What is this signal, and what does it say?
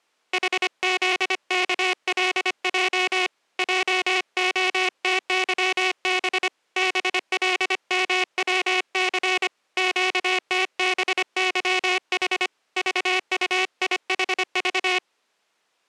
Morse code, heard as a buzzer, hand-sent with a paddle, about 25 wpm. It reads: HZKLJ JOTYB BLMWC QTBYH VUIHV